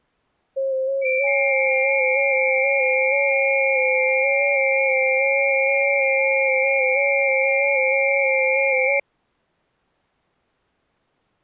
FT8 (several signals at once), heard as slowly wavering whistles, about 6.25 baud.